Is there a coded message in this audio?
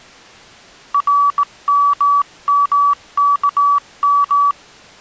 Yes: Morse code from 0.9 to 4.6 s, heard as a keyed tone, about 17 wpm, 1140 Hz. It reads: RMMKM